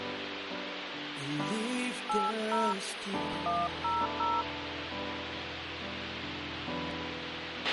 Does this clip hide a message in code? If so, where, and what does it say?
Yes: DTMF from 2.1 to 4.4 s, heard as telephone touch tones, dialled by hand, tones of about 220 ms, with radio hiss and a squelch burst at the end. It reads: 80 100